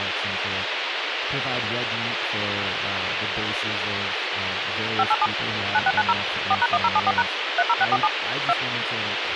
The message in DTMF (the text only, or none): 587 9690 4#1074# 30647 2